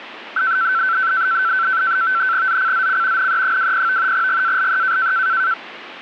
NAVTEX (SITOR-B), 100 baud, 170 Hz shift, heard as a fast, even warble, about 1440 Hz centre. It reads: ZCZC NE20 GALE